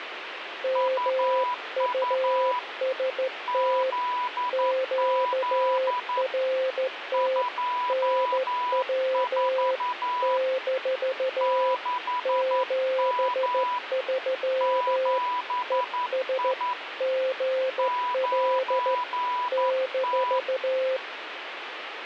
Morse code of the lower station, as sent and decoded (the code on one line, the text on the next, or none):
-- ..- ... - / --.- .-. - / -. .-- / -....- / --... ...-- / . ... / --. .-.. / -....-
MUST QRT NW - 73 ES GL -